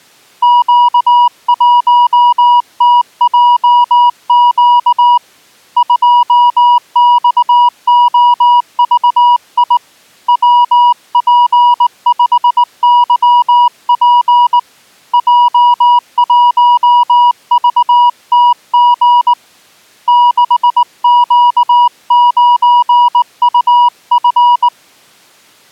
Morse code, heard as a keyed tone, hand-sent with a straight key, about 19 wpm, 970 Hz. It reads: Q1TJQ 2XOVI WP5YP J1VTG 6Q9UF